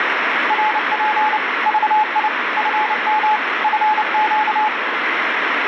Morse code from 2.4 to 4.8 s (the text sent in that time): FM FQ